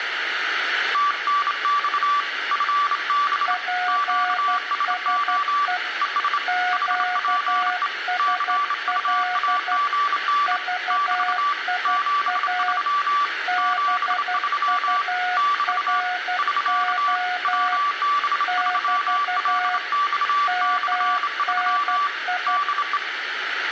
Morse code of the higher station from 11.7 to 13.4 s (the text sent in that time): 73